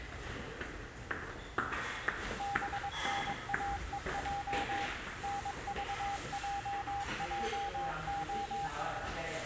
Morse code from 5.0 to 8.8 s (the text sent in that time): NVJJO